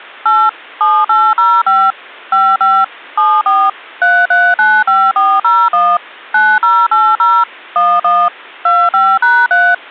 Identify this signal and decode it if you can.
DTMF, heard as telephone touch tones, dialled by machine, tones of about 240 ms. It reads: 8 7805 55 74 3395401 9080 11 25#3